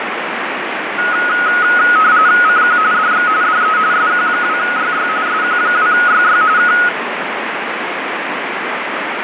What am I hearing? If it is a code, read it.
RTTY (45.45 baud, 170 Hz shift), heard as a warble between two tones, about 1360 Hz centre, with radio static. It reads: CQ DX DE SQ2YY SQ2YY K